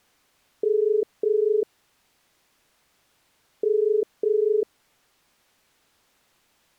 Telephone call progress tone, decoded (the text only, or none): ringback tone